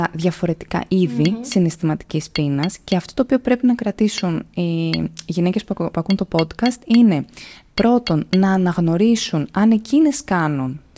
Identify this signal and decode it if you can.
Tap code, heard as taps on glass, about 4 knocks a second, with speech in Greek. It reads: HAS